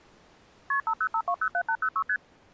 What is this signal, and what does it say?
Multi-frequency trunk signalling (R1, as on North American trunks), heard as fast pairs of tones, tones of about 70 ms. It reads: KP 505207806 ST